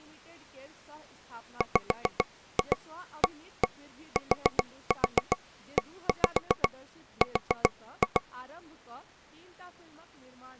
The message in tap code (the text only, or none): WATER